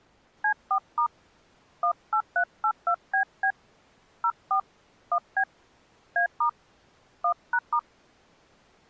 DTMF, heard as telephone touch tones, dialled by hand, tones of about 80 ms. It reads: C4* 18382BB 04 1B A* 1#*